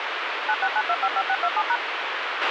DTMF, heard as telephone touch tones, dialled by machine, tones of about 60 ms, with radio hiss and a squelch burst at the end. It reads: 969255627#